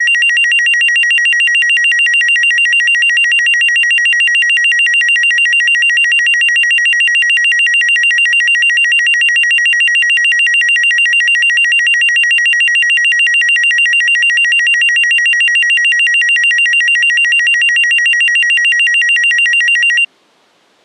A tone that alternates evenly between two pitches. There is no code.